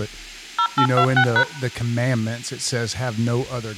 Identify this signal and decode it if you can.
DTMF, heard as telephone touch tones, dialled by machine, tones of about 80 ms, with speech in English. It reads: 0826#